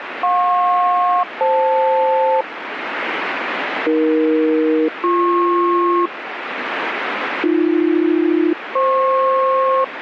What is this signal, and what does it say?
Aircraft SELCAL, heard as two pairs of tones, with radio static. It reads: JP-FL AE-BP AB-FP